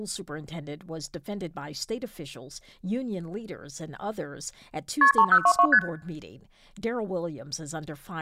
Multi-frequency trunk signalling (R1, as on North American trunks), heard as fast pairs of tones, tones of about 70 ms, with speech in English. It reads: KP 3022 ST